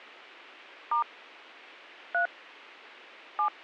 DTMF, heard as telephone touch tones, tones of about 120 ms. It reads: * 3 7